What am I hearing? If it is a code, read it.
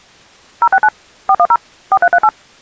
DTMF, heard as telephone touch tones, dialled by machine, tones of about 60 ms. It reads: 069 410 4338